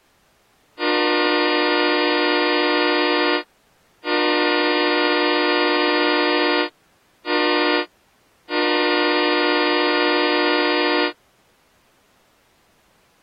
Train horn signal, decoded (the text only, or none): 2 long, 1 short, 1 long